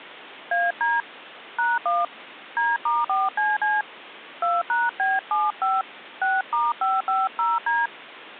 DTMF, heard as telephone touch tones, dialled by hand, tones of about 190 ms. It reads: AD #1 D*4CC 2#B75 6*550D